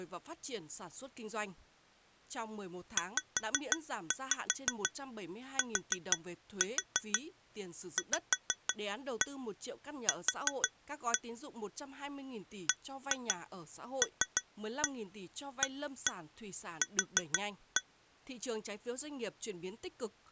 Tap code, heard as taps on glass, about 6 knocks a second, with speech in Vietnamese. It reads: ZTVQ BLAQ